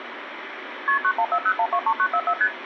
Multi-frequency trunk signalling (R1, as on North American trunks), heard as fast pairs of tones, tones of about 70 ms, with phone line noise. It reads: KP 9140123944 ST